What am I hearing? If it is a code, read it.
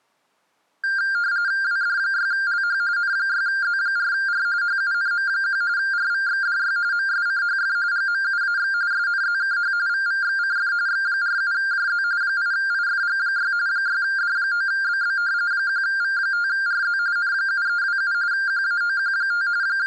RTTY (45.45 baud, 170 Hz shift), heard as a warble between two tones, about 1500 Hz centre. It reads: WD6LH N6Z4R HUNM1 RVXDY MSCHF GMUAX SNZKH VVXCF X47JZ 8IFG6 6D9BB 1V5RZ N7327 QAOQ5 …